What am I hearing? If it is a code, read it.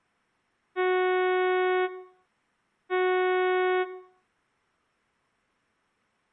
Ship horn signal, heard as a ship's horn, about 370 Hz, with room echo. 2 short. At sea: I am altering course to port.